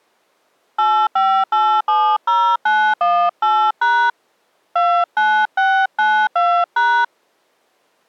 DTMF, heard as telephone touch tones, dialled by hand, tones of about 290 ms. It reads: 85870918# 29692#